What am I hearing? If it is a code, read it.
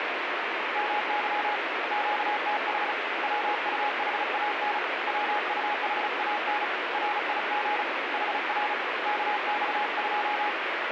Morse code, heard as a keyed tone, hand-sent with a paddle, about 35 wpm, 840 Hz, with heavy radio static. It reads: MY QTH WUHAN WUHAN RIG HR KX2